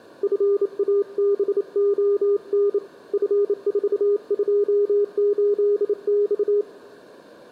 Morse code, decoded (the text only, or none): FABON F428X